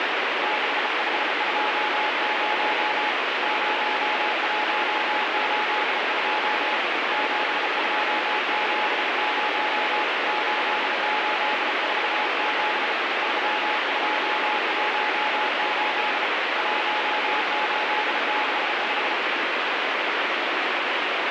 Morse code, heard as a keyed tone, hand-sent with a bug key, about 34 wpm, 850 Hz, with heavy radio static. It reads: 6520 0182 7270 8847 3218 1865